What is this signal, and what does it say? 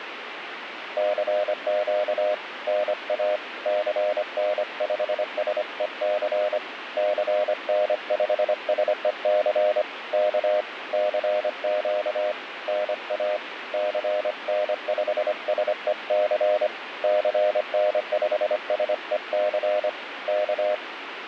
Morse code, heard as a keyed tone, hand-sent with a paddle, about 25 wpm, 610 Hz, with radio static. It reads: CQ NA CN5SEC CN5SEC K CQ NA CN5SEC CN5SEC K